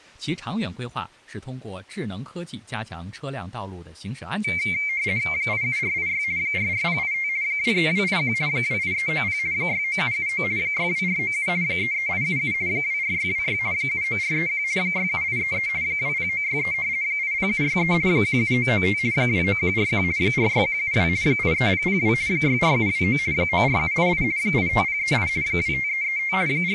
RTTY (50 baud, 170 Hz shift), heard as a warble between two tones, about 2200 Hz centre, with speech in Chinese. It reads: 87486 44085 23281 28390 69779 62497 33877 24626 79431 67833 20963 80763 17995 29141 46172 83002 64729 94788 85038 25335 …